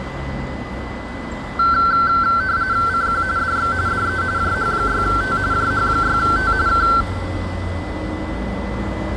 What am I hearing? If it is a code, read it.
RTTY (45.45 baud, 170 Hz shift), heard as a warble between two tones, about 1440 Hz centre, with a steady whistle near 2010 Hz and the noise of a residential street. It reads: CQ DX DE JH6T JH6T K